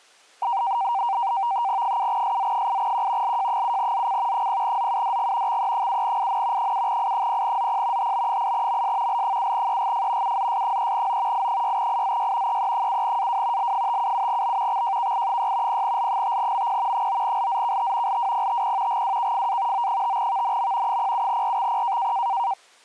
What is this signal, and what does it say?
NAVTEX (SITOR-B), 100 baud, 170 Hz shift, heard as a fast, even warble, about 860 Hz centre. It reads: 7SZ8Q LJ7ZC 0ZUDG XE7IN 7I0ZP HB8MS L7EGF UZS3O I6IZY EE7AW L577B XJKI6 0L5MP 9LZKT LWPTP GWKFA O5VNM 07RXP